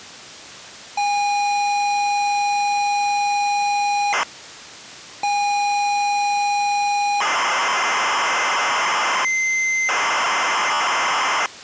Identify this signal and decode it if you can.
ZX Spectrum tape loading, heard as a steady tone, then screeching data.